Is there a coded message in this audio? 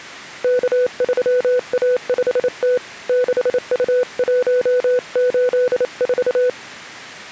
Yes: Morse code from 0.4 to 6.6 s, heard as a keyed tone, hand-sent with a paddle, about 28 wpm, 500 Hz. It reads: K3A5T 6U184